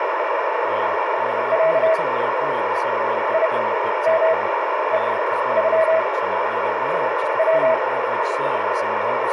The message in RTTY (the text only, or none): none